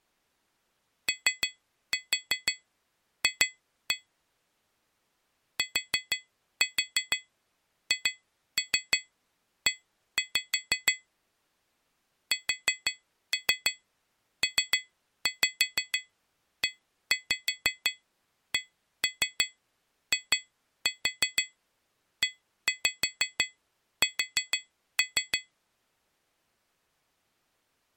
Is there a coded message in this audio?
Yes: tap code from 1.1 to 25.5 s, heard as taps on glass, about 6 knocks a second. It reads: OF THE SPECIES